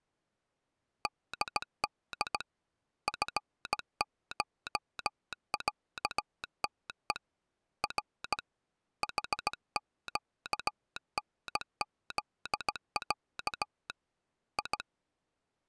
Morse code (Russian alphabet), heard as a telegraph sounder, hand-sent with a straight key, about 17 wpm. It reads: ДД ФШЯТЕ Р ХЩНЗЯ И